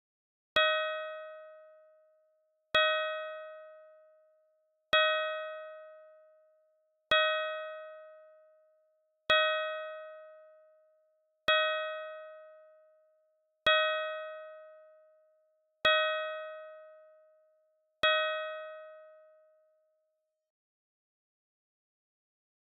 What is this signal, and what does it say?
Clock strike, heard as a bell. 9. Nine o'clock.